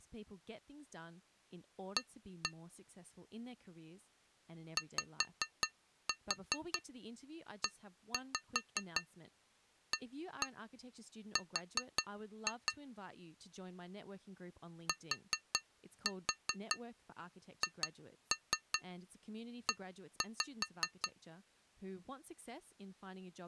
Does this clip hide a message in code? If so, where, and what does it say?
Yes: tap code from 2.0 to 21.2 s, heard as taps on glass, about 5 knocks a second, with speech in English. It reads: A YEAR THE